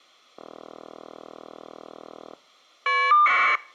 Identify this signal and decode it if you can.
Caller ID data burst, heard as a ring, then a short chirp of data, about 1200 baud.